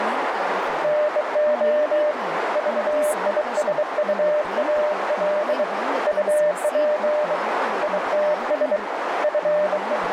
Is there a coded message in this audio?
Yes: Morse code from 0.8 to 10.1 s, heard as a keyed tone, hand-sent with a bug key, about 23 wpm, 600 Hz, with heavy radio static, a narrow filter and speech in Kannada. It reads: NO VISUAL UP ITS …